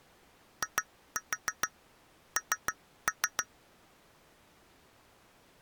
Tap code, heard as taps on glass, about 6 knocks a second. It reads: IN